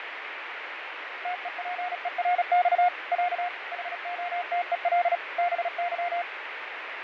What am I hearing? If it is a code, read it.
Morse code (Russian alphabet), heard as a keyed tone, machine-sent, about 36 wpm, 720 Hz, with radio static and fading. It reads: ТЕПЕРЬ Я ХОТЕЛ БЫ